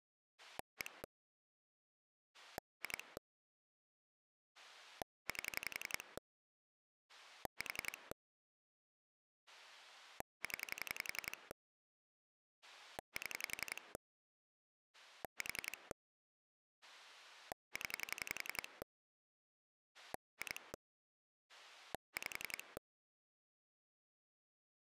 Pulse dialling, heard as a rotary dial, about 11 pulses a second. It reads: 1 2 8 4 0 7 4 0 2 5